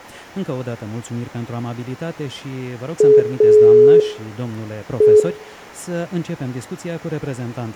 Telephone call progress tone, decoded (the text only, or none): dial tone